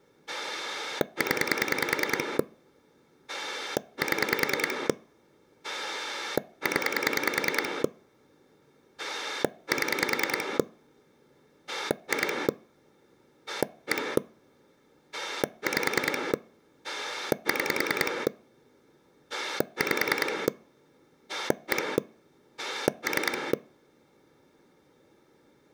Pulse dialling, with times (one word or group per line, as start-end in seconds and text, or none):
0.3-2.4 0
3.3-4.9 7
5.6-7.8 0
9.0-10.6 7
11.7-12.5 2
13.5-14.2 1
15.1-16.3 5
16.8-18.3 6
19.3-20.5 5
21.3-22.0 1
22.6-23.5 3